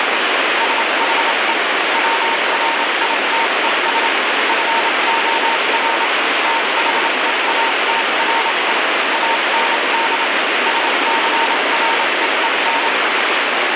Morse code, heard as a keyed tone, machine-sent, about 27 wpm, spaced as for 24 wpm, 920 Hz, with heavy radio static. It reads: SHE WRITES FOR THEATRE AND SCREEN